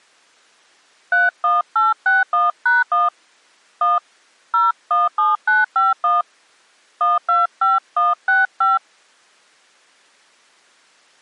DTMF, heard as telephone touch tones, dialled by hand, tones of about 170 ms. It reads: 31861#1 1 017951 125165